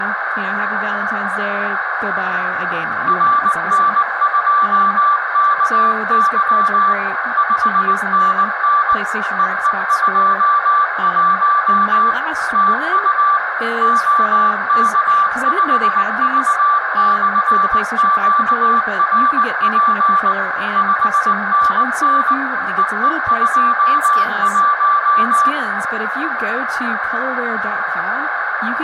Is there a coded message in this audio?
Yes: Morse code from 3.0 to 25.6 s, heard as a keyed tone, machine-sent, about 19 wpm, 1170 Hz, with radio static, a narrow filter, room echo and speech in English. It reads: RN2KY 5NN EE21 TU OK5V/QRP 5NN EE21